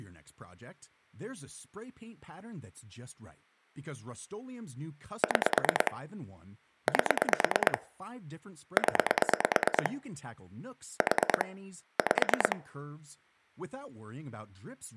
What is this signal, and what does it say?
Pulse dialling, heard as clicks on a phone line, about 9 pulses a second, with speech in English. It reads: 6 8 0 4 5